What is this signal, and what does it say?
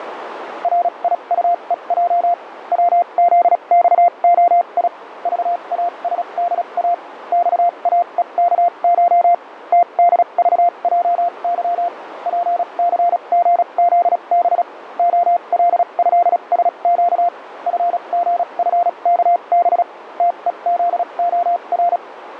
Morse code (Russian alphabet), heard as a keyed tone, machine-sent, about 36 wpm, spaced as for 29 wpm, 700 Hz, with radio static and a narrow filter. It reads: РИУЕЙ ВЗЬОИ ЖАСДА ЬАЕКШ ТДЖЙЫ ПЦГЗБ ОЛЭСЩ ФГФКБ ТЕЗОР